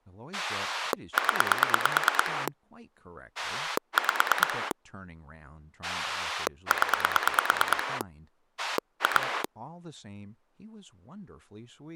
Pulse dialling, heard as a rotary dial, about 9 pulses a second, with speech in English. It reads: 0 5 0 2